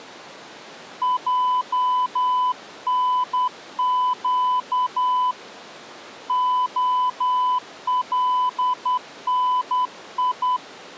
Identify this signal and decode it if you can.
Morse code (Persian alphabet), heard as a keyed tone, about 10 wpm, 1000 Hz. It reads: جنگ علنی